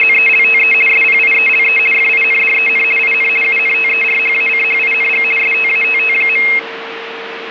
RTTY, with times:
0.0-0.7 …
0.9-1.8 SPIELE
1.9-2.8 FINDEN
3.0-3.3 IN
3.4-5.2 UNTERHACHING
5.4-6.4 STATT.

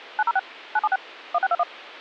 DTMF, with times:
0.2-0.4 906
0.8-1.0 976
1.3-1.6 1621

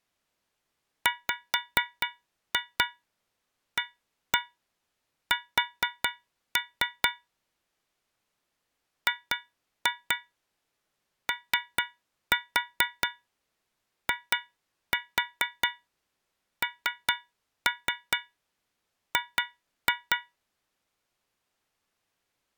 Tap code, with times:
1.1-7.1 WAS
9.1-20.2 GOING

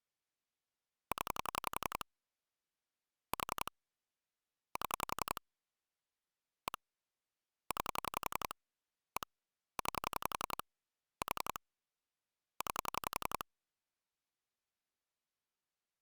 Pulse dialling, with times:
1.1-2.0 0
3.3-3.7 4
4.8-5.4 7
6.7-6.8 1
7.7-8.5 9
9.2-9.3 1
9.8-10.6 9
11.2-11.6 4
12.6-13.4 9

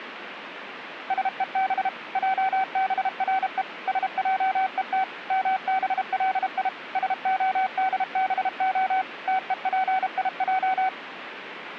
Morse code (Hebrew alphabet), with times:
1.1-1.9 שוב
2.2-3.6 עברו
3.9-5.0 שעות
5.3-6.7 מבלי
7.0-9.0 שהדבה
9.3-10.9 תופיע

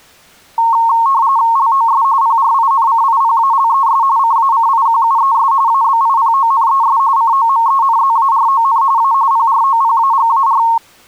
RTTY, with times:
1.6-2.0 LOS
2.2-4.0 PRINCIPALES
4.2-5.5 CACIQUES
5.7-7.0 ABIPONES
7.2-8.8 COMENZARON
9.0-9.1 A
9.3-10.6 PROPAGAR

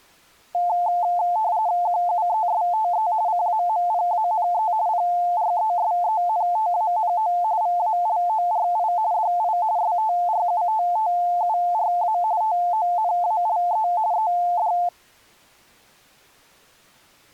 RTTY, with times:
1.9-3.1 QUESTE
3.3-4.7 CAMPANE
4.9-7.3 PRESENTANO
7.6-8.9 VALORI
9.1-9.6 DI
9.8-12.2 STRUTTURA
12.4-13.9 TONALE
14.1-14.7 ED

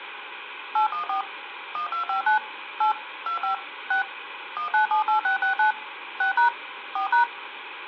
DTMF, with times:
0.8-1.2 814
1.8-2.4 1259
2.8-2.9 8
3.3-3.5 25
3.9-4.0 6
4.6-5.7 1978669
6.2-6.5 6#
7.0-7.2 4#

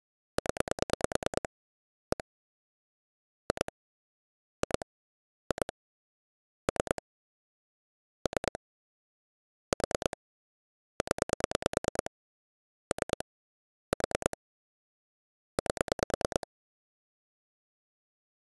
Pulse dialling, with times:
0.4-1.5 0
2.1-2.2 1
3.5-3.7 2
4.6-4.9 2
5.5-5.7 2
6.7-7.0 3
8.3-8.6 3
9.7-10.2 4
11.0-12.1 0
12.9-13.2 3
13.9-14.4 4
15.6-16.5 8

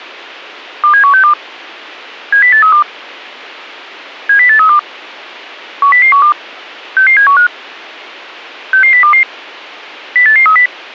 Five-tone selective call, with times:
0.8-1.3 27162
2.3-2.8 70832
4.3-4.8 70832
5.8-6.3 10012
7.0-7.5 66715
8.7-9.2 66022
10.2-10.7 08830

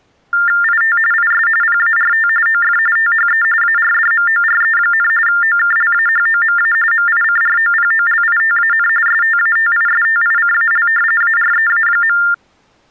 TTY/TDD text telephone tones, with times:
0.6-1.0 IT
1.1-1.5 IS
1.6-2.3 PART
2.5-2.8 OF
3.0-3.4 THE
3.6-5.1 ARDMORE,
5.3-6.7 OKLAHOMA
6.9-8.9 MICROPOLITAN
9.1-10.9 STATISTICAL
11.2-12.2 AREA.

